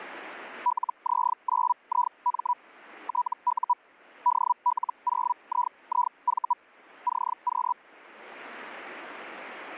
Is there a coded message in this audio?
Yes: Hellschreiber (Feld-Hell, 122.5 baud) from 0.7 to 7.7 s, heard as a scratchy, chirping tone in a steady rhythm, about 980 Hz. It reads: LZ9IM TU DL0IIV CQ